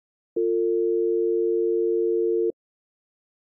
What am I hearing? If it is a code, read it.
Telephone call progress tone (North American or UK plan), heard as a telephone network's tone, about 350, 450 Hz. Dial tone.